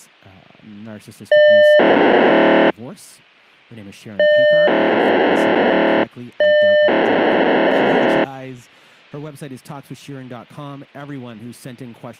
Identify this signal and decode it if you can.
POCSAG pager data (1200 baud), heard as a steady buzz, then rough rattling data, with speech in English.